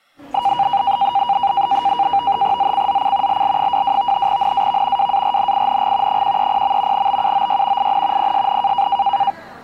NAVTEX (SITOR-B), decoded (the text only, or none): ZCZC LL22 NAV WARNING 130. BUOY IN PSN